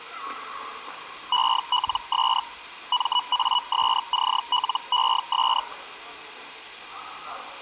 Hellschreiber (Feld-Hell, 122.5 baud), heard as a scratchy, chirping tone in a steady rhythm, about 980 Hz, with the noise of a subway station. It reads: ELS MASCLES